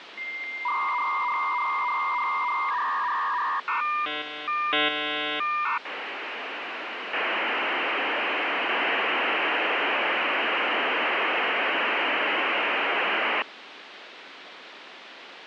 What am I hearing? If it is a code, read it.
Dial-up modem handshake (V.34 or later), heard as a whistle, warbles, then hiss, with phone line noise.